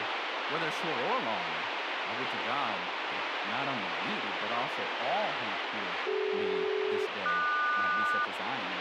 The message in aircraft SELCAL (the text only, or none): CD-QS